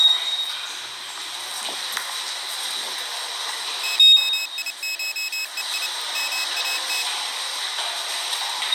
Morse code (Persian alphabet), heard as a high beeper, machine-sent, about 29 wpm, 2550 Hz, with the noise of a subway station. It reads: شیشهی مات